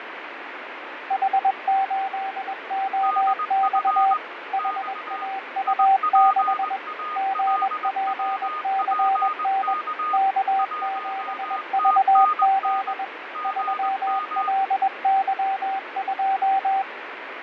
Morse code, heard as two keyed tones, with radio static and fading. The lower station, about 21 wpm, 780 Hz: H8OX HAU6 GPCN K7VZ 3LY2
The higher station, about 20 wpm, 1230 Hz: DF X IPALWPK 1TNN GM